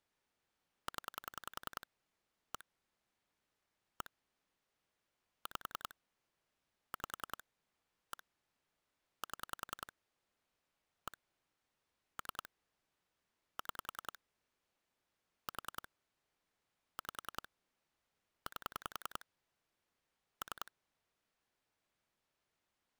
Pulse dialling, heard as clicks on a phone line, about 10 pulses a second. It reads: 0 1 1 5 5 1 7 1 3 6 4 5 8 3